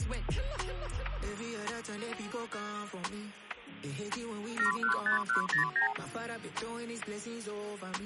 Multi-frequency trunk signalling (R2, with the far end's replies), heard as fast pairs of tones, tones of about 120 ms. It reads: 715109